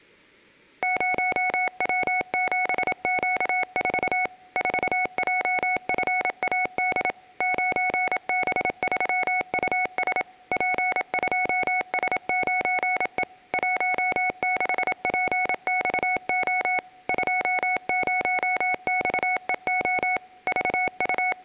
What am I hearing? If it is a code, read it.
Morse code, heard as a keyed tone, machine-sent, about 27 wpm, 740 Hz, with room echo. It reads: 0W7Q4 4JFAD 9B3US P2S9E 16PXO 20XEO …